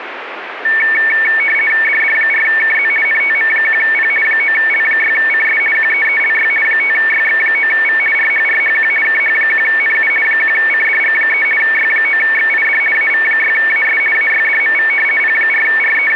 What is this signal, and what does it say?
RTTY (50 baud, 450 Hz shift), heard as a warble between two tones, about 2000 Hz centre, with radio static. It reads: DD4KZ NTM1P 9L6CS QEELY 5YX9V RHRHQ KH1NU 1CDG3 Y9XID AV6AS AYDMV …